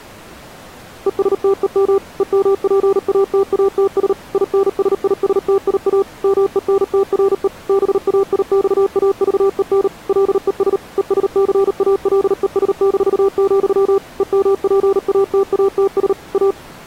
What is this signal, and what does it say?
Morse code, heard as a keyed tone, machine-sent, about 38 wpm, 390 Hz. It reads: ESTEM EMPATATS INSISTIA MENTRE BAIXAVEN LES ESCALES-, EMPATATS A